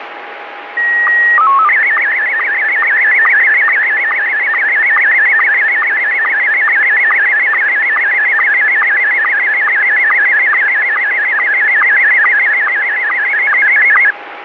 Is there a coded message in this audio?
Yes: SSTV (slow-scan television), Scottie S1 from 0.8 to 14.1 s, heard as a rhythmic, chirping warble, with radio static.